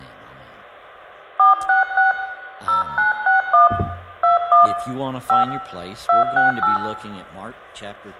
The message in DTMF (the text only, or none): 466 0961 21 5 268